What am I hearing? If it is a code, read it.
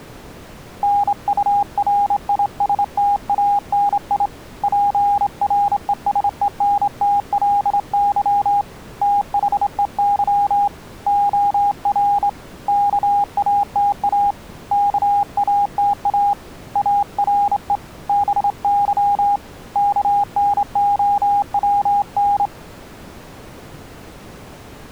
Morse code, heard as a keyed tone, hand-sent with a straight key, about 26 wpm, 810 Hz. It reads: NURISTANI PRESENTLY THEY OR KATA KATA ARE BY KNOWN